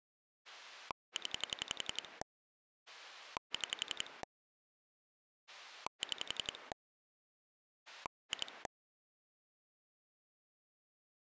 Pulse dialling, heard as a rotary dial, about 11 pulses a second. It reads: 0 6 6 2